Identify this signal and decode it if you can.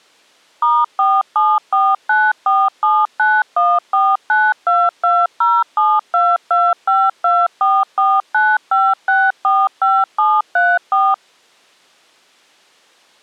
DTMF, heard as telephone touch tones, dialled by machine, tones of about 220 ms. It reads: *4749479149220722524495645734